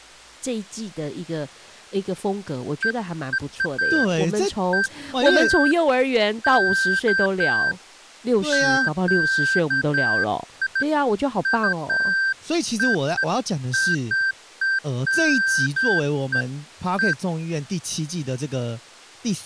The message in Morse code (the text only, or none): none